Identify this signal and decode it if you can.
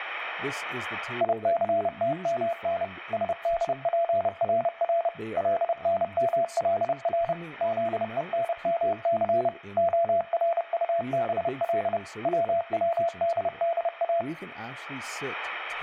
Morse code (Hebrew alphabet), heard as a keyed tone, machine-sent, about 30 wpm, 680 Hz, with speech in English. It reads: יסתמן שדפרר לנמלר זונמס הרטבל צצדדא